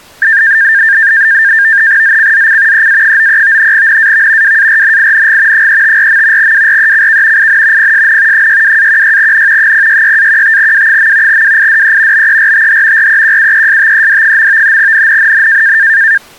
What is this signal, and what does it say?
NAVTEX (SITOR-B), 100 baud, 170 Hz shift, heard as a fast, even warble, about 1700 Hz centre. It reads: ZCZC EA93 NAV WARNING 354. WRECK IN PSN 62-16N 066-15W. WIDE BERTH REQUESTED. NNNN